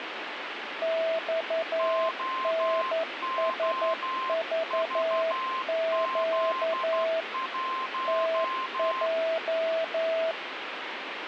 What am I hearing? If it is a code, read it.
Morse code, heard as two keyed tones, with radio static. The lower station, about 11 wpm, 650 Hz: XNSVQ TJ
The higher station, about 12 wpm, 1050 Hz: OOVZ1